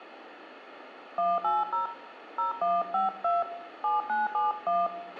DTMF, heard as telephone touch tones, dialled by hand, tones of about 180 ms, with radio hiss, a squelch burst at the end and room echo. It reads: 180 0152 7971